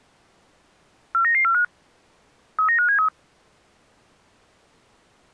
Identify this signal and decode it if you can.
Five-tone selective call (CCIR), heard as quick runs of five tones, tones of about 100 ms. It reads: 49945 39573